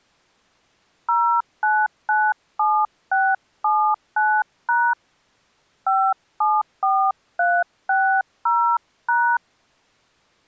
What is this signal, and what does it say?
DTMF, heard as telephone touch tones, dialled by hand, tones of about 270 ms. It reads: 0997679# 574360#